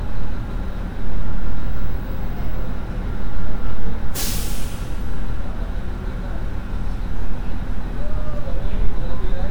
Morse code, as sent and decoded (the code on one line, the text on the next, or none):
none